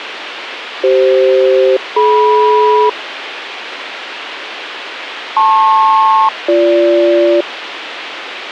Aircraft SELCAL, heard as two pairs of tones, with radio hiss. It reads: CF-DM LP-BG